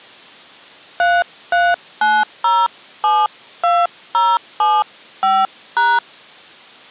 DTMF, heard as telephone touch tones, dialled by hand, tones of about 220 ms. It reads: 339072075#